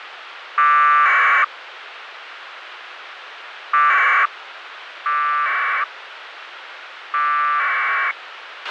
Packet radio (AX.25, as in APRS), 1200 baud, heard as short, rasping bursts, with radio hiss and a squelch burst at the end.